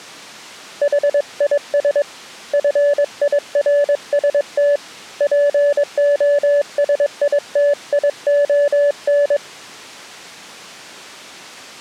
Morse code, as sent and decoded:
.... .. ... / ..-. .. .-. ... - / .--. --- ... .. - .. --- -.
HIS FIRST POSITION

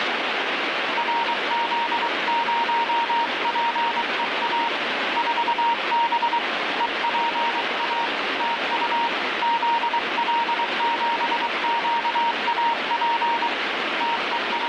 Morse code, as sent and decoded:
.-. --.. ----- .--. . .- / ....- -... / . .--. .- / - ..- / --.. .-.. --... --.- .- .--. / …
RZ0PEA 4B EPA TU ZL7QAP …

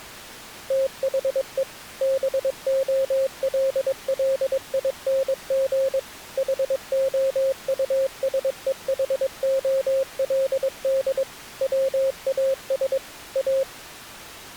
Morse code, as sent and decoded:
- .... . / -... --- .-.. .-.. .. -. --. / .... --- ..- ... . .... --- .-.. -.. / .-- .- ... / .-
THE BOLLING HOUSEHOLD WAS A

